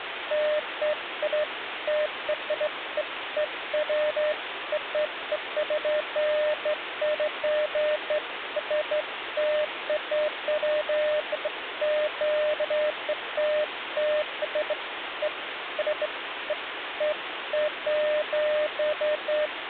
Beeps of irregular length, with phone line noise. There is no code.